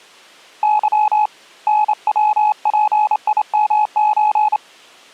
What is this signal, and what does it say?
Morse code (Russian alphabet), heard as a keyed tone, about 28 wpm, 850 Hz. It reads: Ы НВПИМЧ